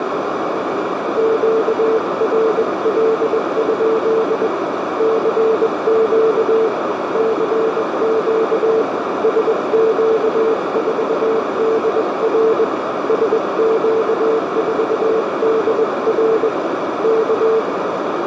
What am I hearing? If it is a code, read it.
Morse code, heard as a keyed tone, hand-sent with a paddle, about 21 wpm, 450 Hz, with heavy radio static and a narrow filter. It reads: QRL? CQ CQ SQ4DR SQ4DR K